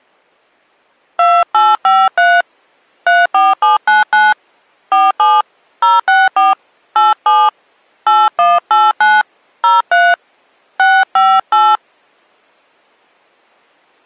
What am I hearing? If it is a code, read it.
DTMF, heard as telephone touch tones, dialled by hand, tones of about 200 ms. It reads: 2853 34799 47 064 87 8189 03 658